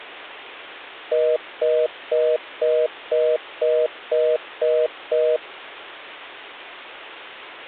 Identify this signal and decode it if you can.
Telephone call progress tone (North American plan), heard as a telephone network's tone, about 480, 620 Hz, 0.25 s on and 0.25 s off. Congestion tone.